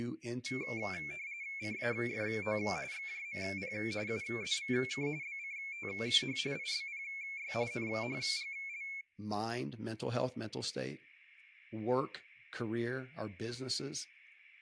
RTTY (45.45 baud, 170 Hz shift), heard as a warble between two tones, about 2250 Hz centre, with speech in English. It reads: CAFO XJMP UZVK BCTH IBPY NHGL